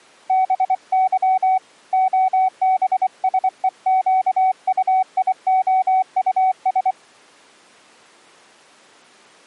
Morse code, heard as a keyed tone, hand-sent with a paddle, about 24 wpm, 750 Hz. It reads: BY OBSEQUIOUS